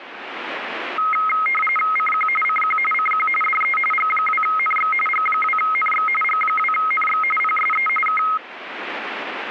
RTTY (45.45 baud, 850 Hz shift), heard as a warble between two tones, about 1700 Hz centre, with radio static. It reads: CQ CQ CQ DE G2NX G2NX G2NX PSE K